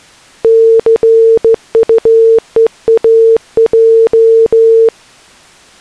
Morse code, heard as a keyed tone, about 15 wpm, 450 Hz. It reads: CUEAJ